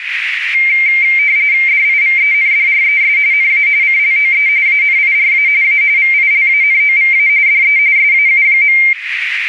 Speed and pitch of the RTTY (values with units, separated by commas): 45.45 baud, 170 Hz shift, 2200 Hz centre